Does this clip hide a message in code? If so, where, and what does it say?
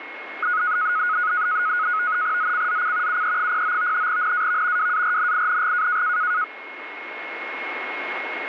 Yes: NAVTEX (SITOR-B), 100 baud, 170 Hz shift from 0.4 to 6.4 s, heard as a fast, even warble, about 1360 Hz centre, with radio static and a steady whistle near 2160 Hz. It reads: ZCZC UE09 NAV WARNING